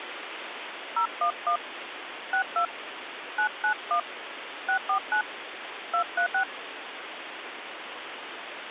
DTMF, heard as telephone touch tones, dialled by hand, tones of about 90 ms, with phone line noise. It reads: 011 62 991 649 236